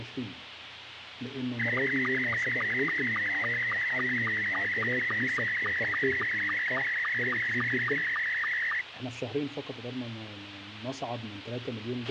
SSTV (slow-scan television), Scottie S2, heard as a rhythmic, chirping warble, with radio hiss and a squelch burst at the end.